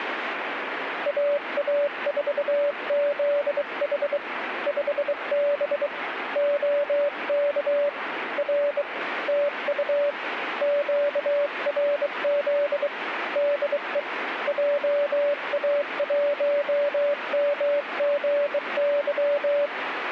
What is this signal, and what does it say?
Morse code, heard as a keyed tone, hand-sent with a bug key, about 23 wpm, 580 Hz, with radio static. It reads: AA4ZH 5B OK R TU QRZ DE JA1MGY